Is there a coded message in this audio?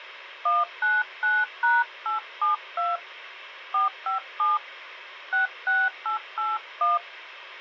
Yes: DTMF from 0.5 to 7.0 s, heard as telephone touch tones, dialled by hand, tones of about 180 ms. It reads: 199#872 457 66881